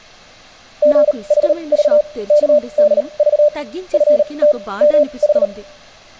Morse code (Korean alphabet), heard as a keyed tone, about 38 wpm, spaced as for 27 wpm, 590 Hz, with speech in Telugu. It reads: 술을 너무